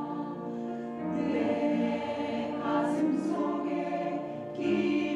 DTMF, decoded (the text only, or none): none